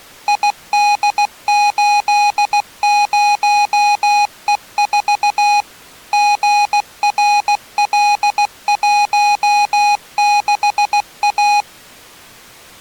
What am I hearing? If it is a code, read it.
Morse code, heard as electronic beeps, machine-sent, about 16 wpm, 830 Hz. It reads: ID80E4 GRL16A